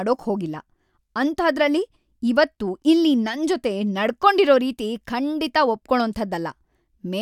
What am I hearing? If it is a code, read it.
Speech in Kannada. There is no code.